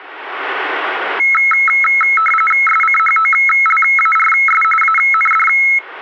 RTTY (45.45 baud, 850 Hz shift), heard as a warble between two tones, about 1750 Hz centre. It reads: SCHOLARS AND